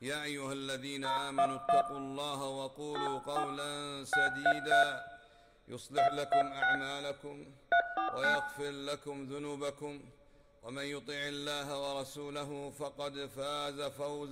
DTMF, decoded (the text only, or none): 011 84 633 226 349